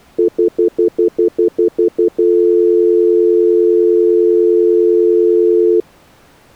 Telephone call progress tone (North American plan), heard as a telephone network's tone, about 350, 440 Hz, 0.1 s on and 0.1 s off. Stutter dial tone.